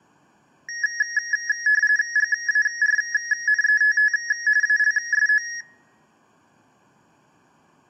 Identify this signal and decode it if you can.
RTTY (45.45 baud, 170 Hz shift), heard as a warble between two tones, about 1800 Hz centre, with room echo. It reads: GARNETT ALSO